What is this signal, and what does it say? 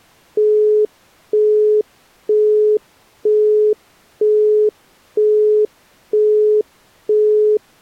Telephone call progress tone (single-tone plan, as in Europe, Japan and elsewhere), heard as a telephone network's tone, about 420 Hz, 0.48 s on and 0.48 s off. Busy tone.